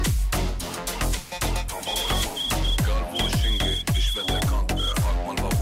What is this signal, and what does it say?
Morse code (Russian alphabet), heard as a whistle, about 9 wpm. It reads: ДВЕ